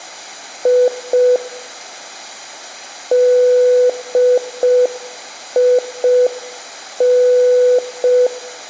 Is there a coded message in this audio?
Yes: Morse code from 0.6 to 8.3 s, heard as a keyed tone, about 5 wpm, 500 Hz, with room echo. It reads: I DIN